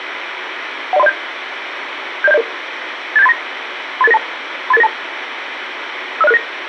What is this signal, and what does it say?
Five-tone selective call (EIA), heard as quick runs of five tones, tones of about 30 ms, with radio hiss. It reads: 10307 70700 87839 38892 38892 50669